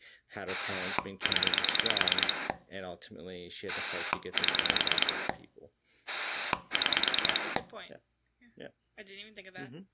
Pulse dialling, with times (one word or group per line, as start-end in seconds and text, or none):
0.5-2.5 0
3.7-5.3 7
6.1-7.6 6